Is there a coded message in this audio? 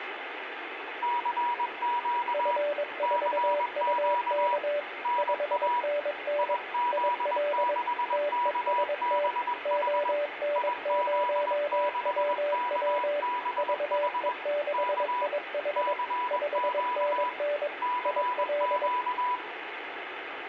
Yes: Morse code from 1.0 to 19.4 s, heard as two keyed tones, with radio static and room echo. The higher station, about 21 wpm, 980 Hz: CQ CQ NA IZ6KBH IZ6KBH K CQ CQ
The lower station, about 22 wpm, 580 Hz: F4UK 5NN IL TEST ON0WW VE6IH 5NN IL